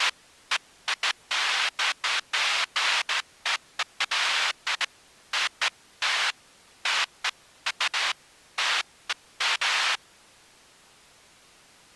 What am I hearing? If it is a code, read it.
Bursts of noise. There is no code.